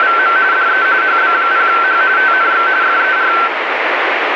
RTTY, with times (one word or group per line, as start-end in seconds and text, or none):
0.0-0.4 …
0.5-0.9 DE
1.0-2.0 HB0H
2.2-2.7 TNX
2.8-3.3 FER